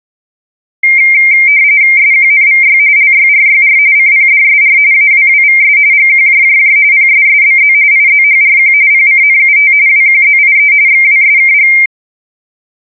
RTTY (45.45 baud, 170 Hz shift), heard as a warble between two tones, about 2200 Hz centre. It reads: SQNVY LYRYR CPDSR AWWVS GQJJJ PSSBZ IZHRQ PCNUT WQZIE XWSKG